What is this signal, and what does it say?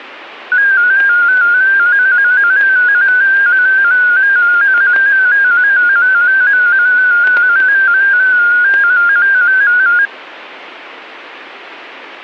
Multi-tone FSK (Olivia or MFSK type), about 250 Hz wide, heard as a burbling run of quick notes, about 15.625 baud, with static crashes.